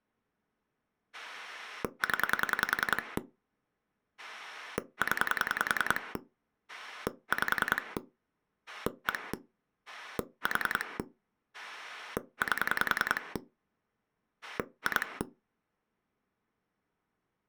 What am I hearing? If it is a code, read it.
Pulse dialling, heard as a rotary dial, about 10 pulses a second. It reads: 0 0 5 1 4 8 2